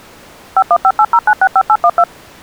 DTMF, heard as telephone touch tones, dialled by machine, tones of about 60 ms. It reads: 51580965812